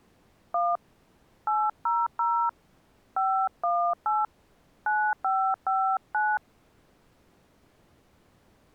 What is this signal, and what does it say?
DTMF, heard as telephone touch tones, dialled by hand, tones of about 250 ms. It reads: 1 800 518 9559